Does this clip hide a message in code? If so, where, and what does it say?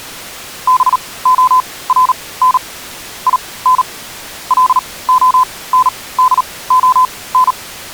Yes: Morse code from 0.6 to 7.6 s, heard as a keyed tone, machine-sent, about 38 wpm, spaced as for 21 wpm, 1020 Hz. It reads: BORN IN LONDON